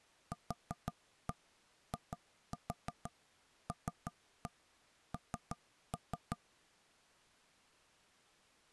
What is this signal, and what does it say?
Tap code, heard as knocks on wood, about 6 knocks a second. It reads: QILN